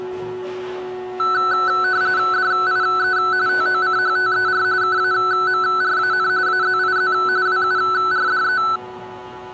RTTY (45.45 baud, 170 Hz shift), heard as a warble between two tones, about 1410 Hz centre, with the noise of a cafe. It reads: DIE TOCHTER KAMRAN AZIZ WURDE